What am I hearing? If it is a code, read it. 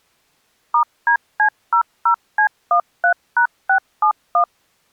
DTMF, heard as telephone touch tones, dialled by machine, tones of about 90 ms. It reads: *DC00C13#671